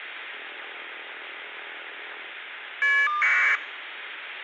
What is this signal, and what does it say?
Caller ID data burst, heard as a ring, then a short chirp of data, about 1200 baud, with phone line noise.